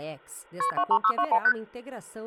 Multi-frequency trunk signalling (R1, as on North American trunks), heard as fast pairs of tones, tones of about 70 ms. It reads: KP 23621 ST